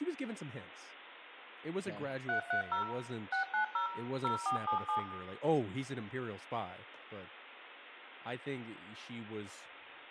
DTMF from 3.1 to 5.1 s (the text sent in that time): 690 0477